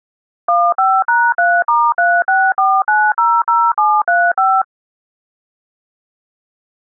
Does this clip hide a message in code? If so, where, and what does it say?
Yes: DTMF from 0.5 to 4.6 s, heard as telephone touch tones, dialled by machine, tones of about 240 ms. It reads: 15#3*364900735